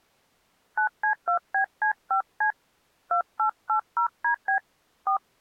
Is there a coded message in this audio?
Yes: DTMF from 0.8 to 5.2 s, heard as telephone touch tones, dialled by hand, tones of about 100 ms. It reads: 9C2BC5C 2880DB 4